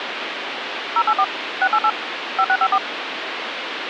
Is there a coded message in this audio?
Yes: DTMF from 1.0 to 2.8 s, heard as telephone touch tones, dialled by machine, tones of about 60 ms, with phone line noise. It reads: 084 688 5654